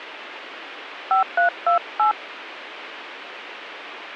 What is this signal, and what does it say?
DTMF, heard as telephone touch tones, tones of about 100 ms, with radio hiss. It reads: 5328